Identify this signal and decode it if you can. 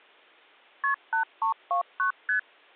Multi-frequency trunk signalling (R1, as on North American trunks), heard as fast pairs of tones, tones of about 110 ms. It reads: KP 8329 ST